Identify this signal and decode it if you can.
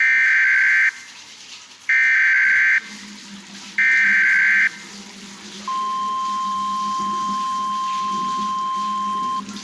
Emergency Alert System (SAME) tones (header bursts, then the 1050 Hz attention tone), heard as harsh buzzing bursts, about 520.83 baud, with the noise of a restroom.